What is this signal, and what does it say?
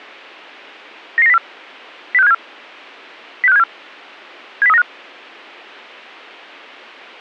Five-tone selective call (EEA), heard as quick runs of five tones, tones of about 40 ms. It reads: 99904 06574 06574 70395